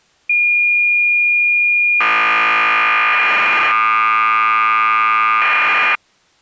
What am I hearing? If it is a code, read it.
Cassette data (Kansas City type), 1200 baud, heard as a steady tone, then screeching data.